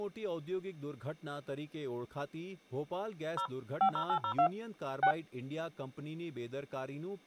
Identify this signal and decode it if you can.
DTMF, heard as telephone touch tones, dialled by machine, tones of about 80 ms, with speech in Gujarati. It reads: 0 50802 6